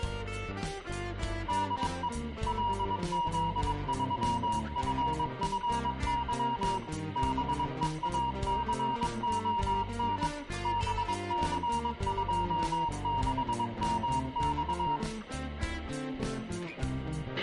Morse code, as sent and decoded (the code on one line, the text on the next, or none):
-.. . / .-.. --.. ...-- ..-. ..-. -.-- / -... . .- -.-. --- -. / -... -.-. ..--- -.... -- -..-
DE LZ3FFY BEACON BC26MX